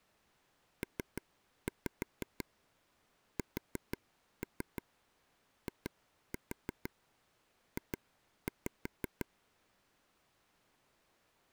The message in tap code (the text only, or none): PSIJ